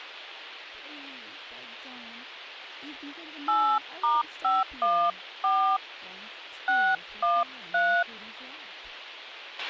DTMF, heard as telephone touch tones, dialled by hand, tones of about 260 ms, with a squelch burst at the end and speech in English. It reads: 8*514 613